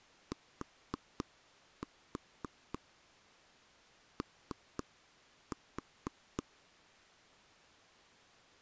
Tap code, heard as taps on a table, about 4 knocks a second. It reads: TO